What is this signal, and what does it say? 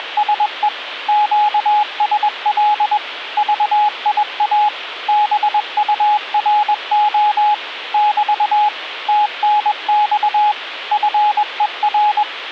Morse code, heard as a keyed tone, machine-sent, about 21 wpm, 840 Hz. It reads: … QSL VIA BURO <BT> TNX FER